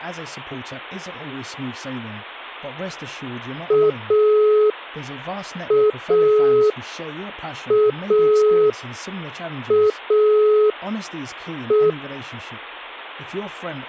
Telephone call progress tone (pulsed, as in Italy), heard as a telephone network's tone, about 420 Hz, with speech in English. Dial tone.